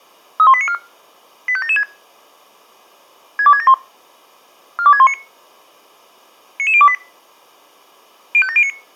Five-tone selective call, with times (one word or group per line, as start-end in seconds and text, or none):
0.4-0.7 31894
1.5-1.8 85776
3.4-3.7 62671
4.8-5.1 42619
6.6-6.9 99028
8.3-8.7 05709